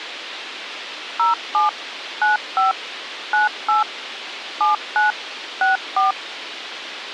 DTMF, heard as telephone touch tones, dialled by machine, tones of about 140 ms, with radio hiss. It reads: 07 95 98 79 64